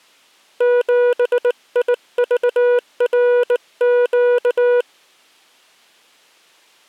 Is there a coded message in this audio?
Yes: Morse code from 0.5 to 4.9 s, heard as a keyed tone, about 19 wpm, 490 Hz. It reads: 7IVRQ